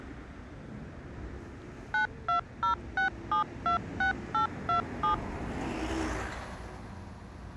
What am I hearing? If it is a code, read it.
DTMF, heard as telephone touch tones, dialled by machine, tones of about 110 ms, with street noise. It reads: 9206726827